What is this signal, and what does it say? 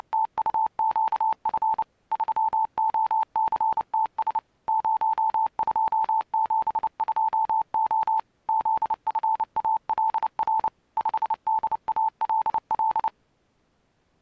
Morse code, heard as a keyed tone, machine-sent, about 29 wpm, 880 Hz. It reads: … 3OCTS 0272O ZFALR 5DALL